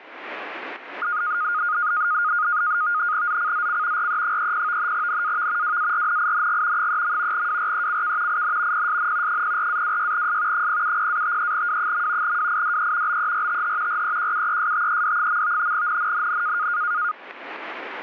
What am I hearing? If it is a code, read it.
NAVTEX (SITOR-B), 100 baud, 170 Hz shift, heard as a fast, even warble, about 1330 Hz centre. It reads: ZCZC RE30 NAV WARNING 3. WRECK IN PSN 04-26S 070-53W. WIDE BERTH REQUESTED. NNNN